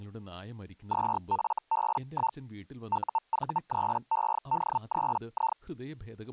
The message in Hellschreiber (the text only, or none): 2FB1 UV3ED3I